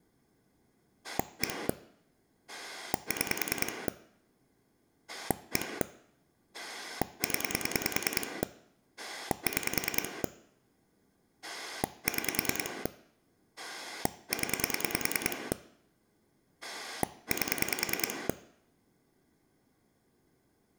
Pulse dialling, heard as a rotary dial, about 10 pulses a second, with room echo. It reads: 1 6 1 0 6 6 0 8